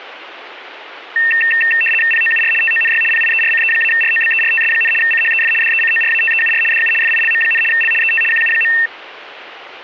RTTY (75 baud, 850 Hz shift), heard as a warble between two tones, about 2250 Hz centre, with radio static. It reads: POUR TONY PIERCE-ROBERTS, CHEF DECORATEUR DU FILM, L ET QU.